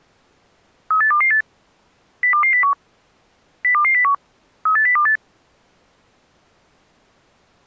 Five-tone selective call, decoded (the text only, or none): 38228 02201 02201 38028